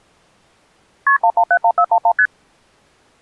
Multi-frequency trunk signalling (R1, as on North American trunks), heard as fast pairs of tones, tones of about 70 ms. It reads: KP 1171411 ST